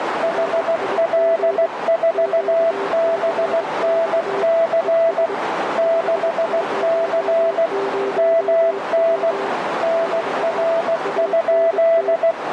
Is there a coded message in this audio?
Yes: Morse code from 0.2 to 12.4 s, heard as two keyed tones, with radio static and a narrow filter. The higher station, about 16 wpm, 660 Hz: HL4BNC 6C MN NR?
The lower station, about 23 wpm, 400 Hz: RIG QCX ES 500W <BT> ANT